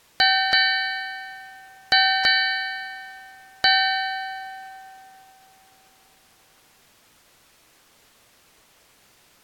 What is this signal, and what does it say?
Ship's bell, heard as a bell. 5. Five half-hours of the watch have passed.